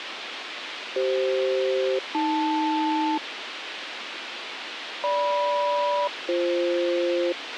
Aircraft SELCAL, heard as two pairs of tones, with radio hiss and a squelch burst at the end. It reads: CF-AL GM-BF